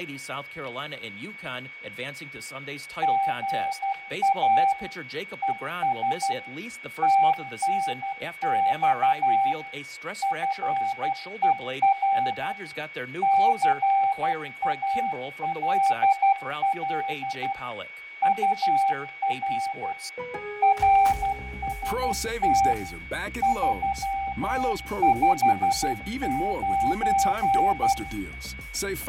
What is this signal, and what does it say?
Morse code, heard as a keyed tone, machine-sent, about 12 wpm, 780 Hz, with fading, static crashes, a steady whistle near 2240 Hz and room echo. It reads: GA ES TNX FER CALL UR RST 359